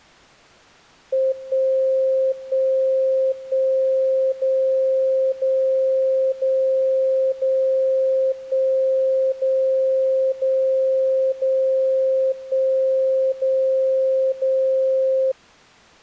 Radio time signal (DCF77), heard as a tone whose level steps once a second, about 530 Hz. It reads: 1 1 1 0 0 0 0 1 0 0 0 1 0 0